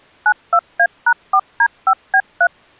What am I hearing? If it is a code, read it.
DTMF, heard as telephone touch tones, dialled by machine, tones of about 70 ms. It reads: 92A#4D5B3